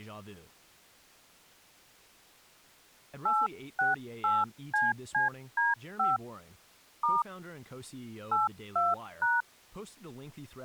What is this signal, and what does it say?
DTMF, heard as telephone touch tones, dialled by hand, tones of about 180 ms, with speech in English. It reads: 868CCD5 * 82#